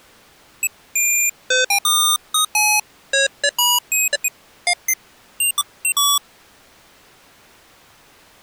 Electronic bleeps of random pitch and length. There is no code.